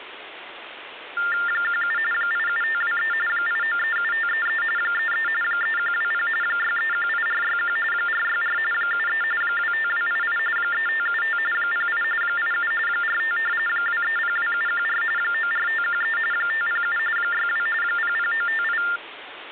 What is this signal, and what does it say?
TTY/TDD text telephone tones (45.45 baud Baudot), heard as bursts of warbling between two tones, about 400 Hz shift, 1600 Hz centre, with phone line noise. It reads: 17 87523 8937533 33 3120 6318461 464 73 25288 3575 08 87 45 2302714 94513 507 62 00958